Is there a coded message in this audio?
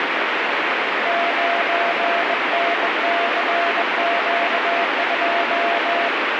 Yes: Morse code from 1.0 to 6.1 s, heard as a keyed tone, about 21 wpm, 690 Hz, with heavy radio static. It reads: 9NCQ2